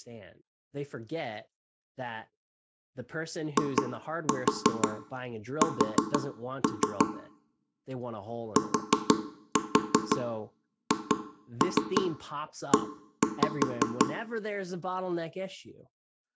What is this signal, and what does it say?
Tap code, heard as knocks on wood, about 5 knocks a second, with room echo and speech in English. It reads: IS THE